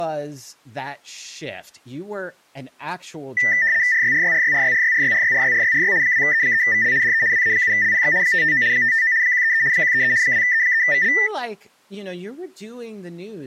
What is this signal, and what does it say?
RTTY (75 baud, 170 Hz shift), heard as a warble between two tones, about 1900 Hz centre, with speech in English. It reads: RYRYRYRYRYRYRYRYRYRY 2E3VL DE WA7LPX 559 559 133 133 2E3VL